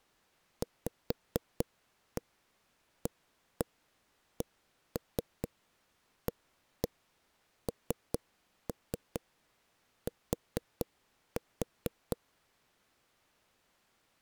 Tap code, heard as knocks on a wall, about 4 knocks a second. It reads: VACANT